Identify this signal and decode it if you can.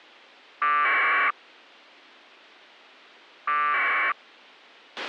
Packet radio (AX.25, as in APRS), 1200 baud, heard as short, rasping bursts, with a squelch burst at the end.